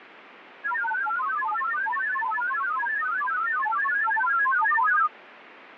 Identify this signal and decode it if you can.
Multi-tone FSK (Olivia or MFSK type), about 1000 Hz wide, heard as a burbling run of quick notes, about 31.25 baud.